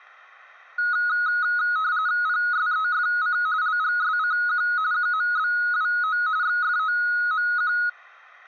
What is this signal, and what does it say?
RTTY (45.45 baud, 170 Hz shift), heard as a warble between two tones, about 1360 Hz centre. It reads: PSEFC LGSCQ QMBWO XFOMQ